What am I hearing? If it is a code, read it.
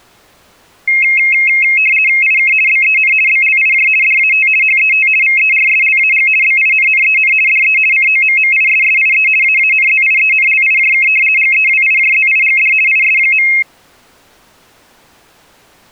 RTTY (50 baud, 450 Hz shift), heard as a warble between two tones, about 2350 Hz centre. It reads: IK BEN BLIJ DAT HET VERSLAG BINNEN DE COMMISSIE AANZIENLIJK GEWIJZIGD IS.